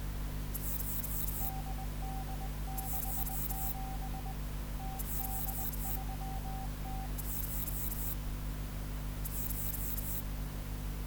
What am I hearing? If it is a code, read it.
Morse code (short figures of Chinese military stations), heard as a keyed tone, hand-sent with a bug key, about 20 wpm, 770 Hz. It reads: 8867 0830